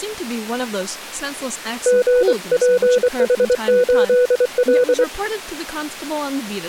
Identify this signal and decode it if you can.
Morse code, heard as a keyed tone, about 24 wpm, 500 Hz, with speech in English. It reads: GPH8L